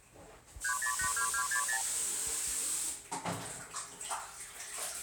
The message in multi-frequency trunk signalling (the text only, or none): 3082260